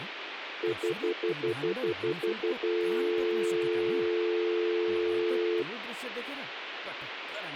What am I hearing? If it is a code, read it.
Telephone call progress tone (North American plan), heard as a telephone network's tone, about 350, 440 Hz, 0.1 s on and 0.1 s off, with phone line noise and speech in Nepali. Stutter dial tone.